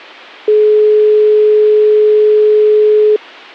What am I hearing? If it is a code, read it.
Telephone call progress tone (425 Hz plan, as in most of Europe), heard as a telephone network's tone, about 420 Hz. Dial tone.